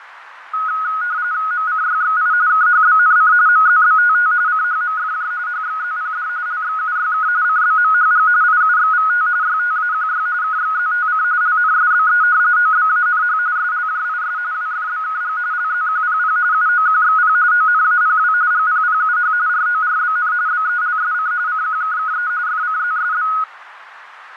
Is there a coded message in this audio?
Yes: RTTY (45.45 baud, 170 Hz shift) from 0.5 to 23.4 s, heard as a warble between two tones, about 1360 Hz centre, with radio static and fading. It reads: MCYXI KHBNC MZBTT CHMFJ HXZPD LXUYK CBMHG IUXVT YTAQY KXZTC LNSBE OBANH SLJIS WFBKG LZQPP UOQXP ONAPW GPPUH RORBN BELSC CQKKE FCZSB